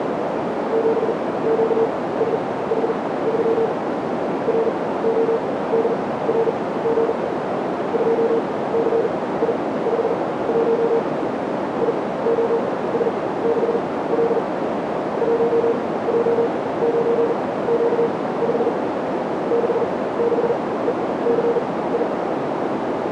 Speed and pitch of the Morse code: 40 wpm, spaced as for 19 wpm, 460 Hz

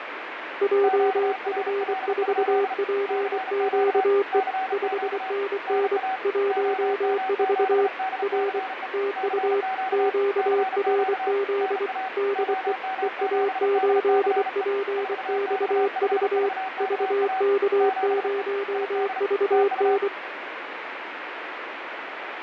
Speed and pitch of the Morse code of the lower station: 24 wpm, 400 Hz

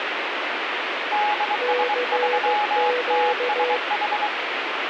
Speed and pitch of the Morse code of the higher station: 23 wpm, 840 Hz

